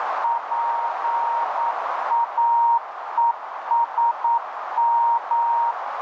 Morse code, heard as a keyed tone, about 9 wpm, 930 Hz, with heavy radio static and a narrow filter. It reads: PAESM